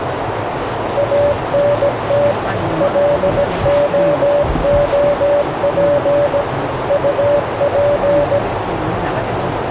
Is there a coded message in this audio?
Yes: Morse code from 0.9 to 8.4 s, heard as a keyed tone, machine-sent, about 17 wpm, 580 Hz, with radio static, a narrow filter and the noise inside a car. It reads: ANT LOOP UP